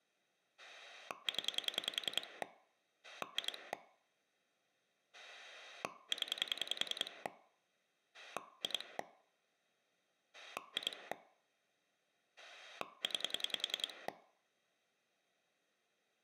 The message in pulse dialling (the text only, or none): 0 2 0 2 2 9